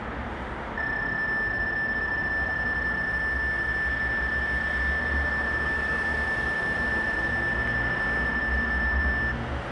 PSK31 (31.25 baud), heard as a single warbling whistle, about 1750 Hz, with street noise.